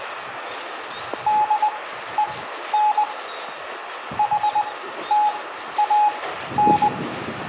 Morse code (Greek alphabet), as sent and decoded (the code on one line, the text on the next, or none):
-.. . -. / .... - .- -.
ΔΕΝ ΗΤΑΝ